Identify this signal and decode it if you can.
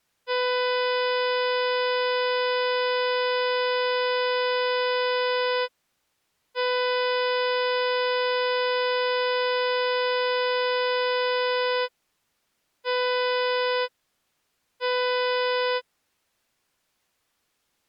Ship horn signal, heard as a ship's horn, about 500 Hz. 2 long, 2 short. At sea: I intend to overtake on your port side.